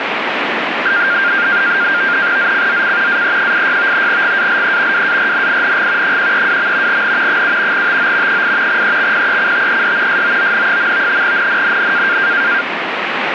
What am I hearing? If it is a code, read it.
NAVTEX (SITOR-B), 100 baud, 170 Hz shift, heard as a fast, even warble, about 1500 Hz centre, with radio static. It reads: ZCZC AE86 GALE WARNING 132. N 7 TO 8 EXPECTED SOON. NNNN